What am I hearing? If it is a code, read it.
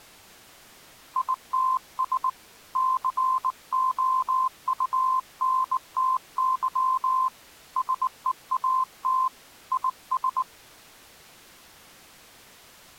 Morse code, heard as a keyed tone, hand-sent with a bug key, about 19 wpm, 1040 Hz. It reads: ITS COUNTY SEAT IS